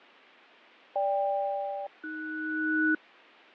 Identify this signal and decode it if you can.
Aircraft SELCAL, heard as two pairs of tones, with radio static and fading. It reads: GK-AS